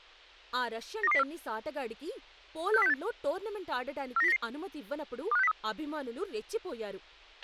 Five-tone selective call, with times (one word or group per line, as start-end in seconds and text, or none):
1.0-1.2 92204
2.7-2.9 64068
4.2-4.4 49099
5.3-5.5 25603